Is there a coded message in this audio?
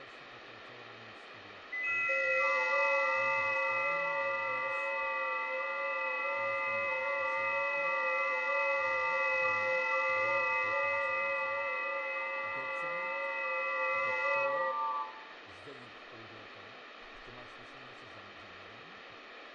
Yes: FT8 (several signals at once) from 1.7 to 15.1 s, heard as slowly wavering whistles, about 6.25 baud, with radio static, fading and room echo.